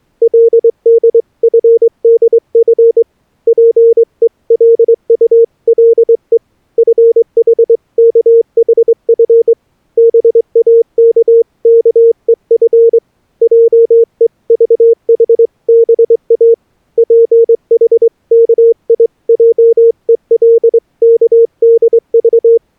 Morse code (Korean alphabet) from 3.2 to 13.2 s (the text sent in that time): 자기가 누운 동안